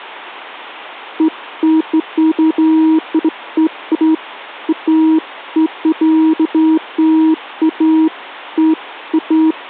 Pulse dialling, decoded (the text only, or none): none